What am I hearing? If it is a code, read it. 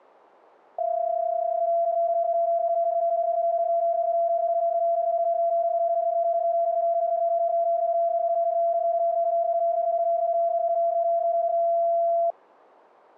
PSK31 (31.25 baud), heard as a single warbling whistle, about 680 Hz.